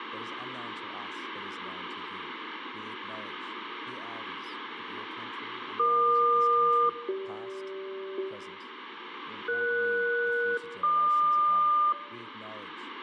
Aircraft SELCAL, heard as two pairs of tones, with radio static, room echo and speech in English. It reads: EQ-CG ES-GQ